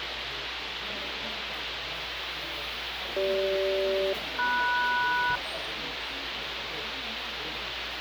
Aircraft SELCAL, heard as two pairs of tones, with radio hiss and the noise of a crowd indoors. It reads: CG-MS